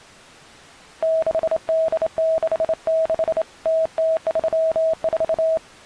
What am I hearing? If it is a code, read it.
Morse code (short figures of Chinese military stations), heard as a keyed tone, hand-sent with a straight key, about 27 wpm, 640 Hz. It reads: 6866 0034